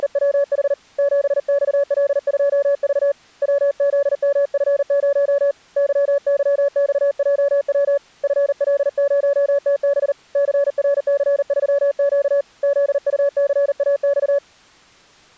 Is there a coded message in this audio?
Yes: Morse code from 0.0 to 14.4 s, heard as a keyed tone, hand-sent with a paddle, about 39 wpm, 560 Hz. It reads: … 7XL2V WZMF0 YYXJW FL0TB CRC3Q ZUCAX